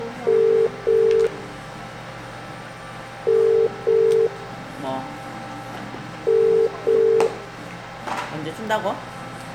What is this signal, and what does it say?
Telephone call progress tone (as in the UK, Ireland, Australia and similar networks), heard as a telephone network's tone, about 400, 450 Hz, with room echo and the noise of a cafe. Ringback tone.